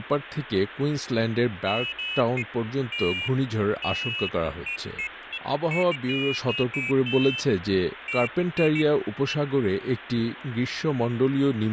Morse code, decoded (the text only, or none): none